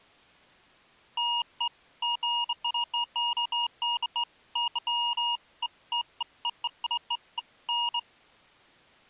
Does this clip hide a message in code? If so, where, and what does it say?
No, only beeps of irregular length.